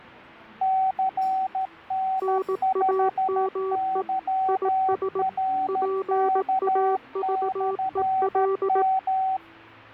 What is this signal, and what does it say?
Morse code, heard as two keyed tones, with the noise of a crowd indoors. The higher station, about 13 wpm, 760 Hz: CN5YRK/M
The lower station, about 18 wpm, 380 Hz: NAME IS PAVEL